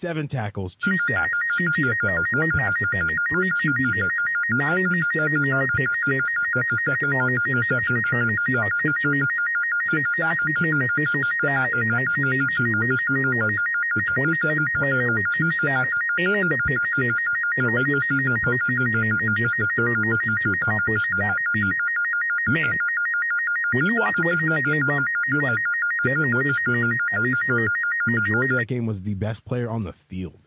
A tone that alternates evenly between two pitches, with speech in English. There is no code.